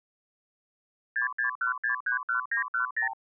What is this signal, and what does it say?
Multi-frequency trunk signalling (R2, with the far end's replies), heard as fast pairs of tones, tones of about 110 ms. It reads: 661631910